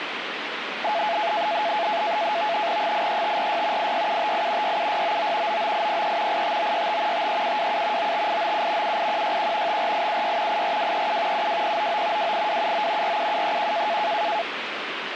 NAVTEX (SITOR-B), 100 baud, 170 Hz shift, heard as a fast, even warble, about 760 Hz centre, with radio static. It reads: 83546 86758 67699 99803 85965 53727 95897 78161 54876 84237 72099 28279 47731